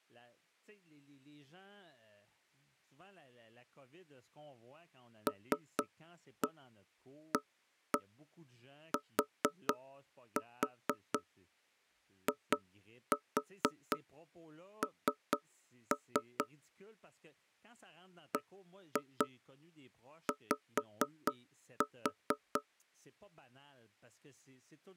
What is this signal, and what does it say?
Tap code, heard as knocks on wood, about 4 knocks a second, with speech in French. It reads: LATIN BY